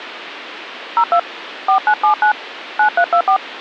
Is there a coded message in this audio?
Yes: DTMF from 1.0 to 3.4 s, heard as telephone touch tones, dialled by hand, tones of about 90 ms, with phone line noise. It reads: 02 4979 9324